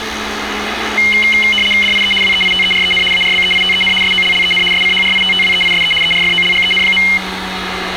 RTTY (75 baud, 850 Hz shift), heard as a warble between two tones, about 2550 Hz centre, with radio static and street noise. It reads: DIE WEITEREN ARBEITEN SOLLEN SCHRITTWEISE ERFOLGEN.